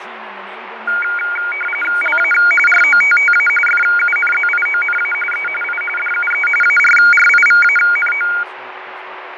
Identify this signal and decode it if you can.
RTTY (45.45 baud, 850 Hz shift), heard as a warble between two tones, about 1850 Hz centre, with radio static, fading and speech in English. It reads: LA ROTTA FUNZIONA E I DUE ARRIVANO